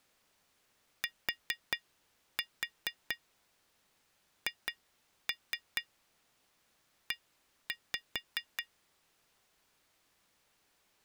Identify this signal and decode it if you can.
Tap code, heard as taps on glass, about 4 knocks a second. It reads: THE